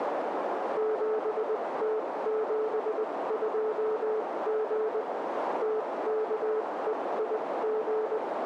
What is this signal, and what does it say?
Morse code, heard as a keyed tone, machine-sent, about 20 wpm, spaced as for 17 wpm, 440 Hz, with radio static and a narrow filter. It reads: 7T72G TKEIG